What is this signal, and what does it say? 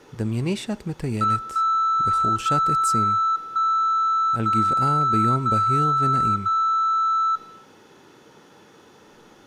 Radio time signal (DCF77), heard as a tone whose level steps once a second, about 1320 Hz, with room echo and speech in Hebrew. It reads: 1 0 1 0 0 0